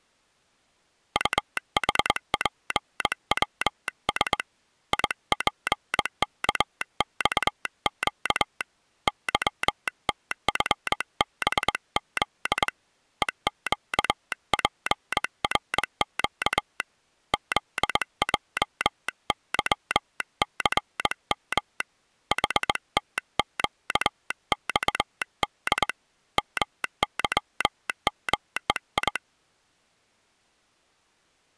Morse code, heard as a telegraph sounder, hand-sent with a straight key, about 21 wpm. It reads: UHPWS IPKXQ YTFBZ EQPRQ ZJYCM HTQXD MYMEI